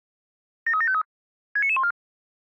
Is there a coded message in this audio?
Yes: five-tone selective call (ZVEI) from 0.7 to 1.9 s, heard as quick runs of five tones, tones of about 70 ms. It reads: 73753 69914